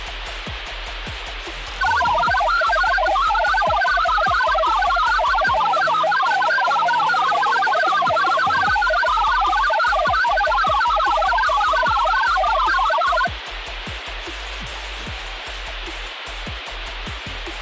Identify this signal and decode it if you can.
Multi-tone FSK (Olivia or MFSK type), about 1000 Hz wide, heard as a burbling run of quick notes, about 62.5 baud, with radio static.